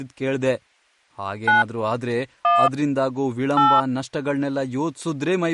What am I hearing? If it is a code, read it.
DTMF, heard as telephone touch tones, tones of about 170 ms, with speech in Kannada. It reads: 9 1 8